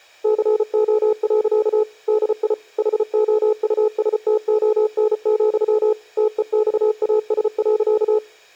Morse code, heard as a keyed tone, machine-sent, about 34 wpm, 430 Hz. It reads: CO. DI HOUSTON, TEXAS.